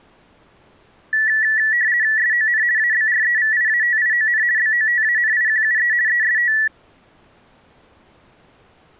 RTTY (50 baud, 170 Hz shift), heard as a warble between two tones, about 1850 Hz centre. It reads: SON ABREVIATION BOTANIQUE EST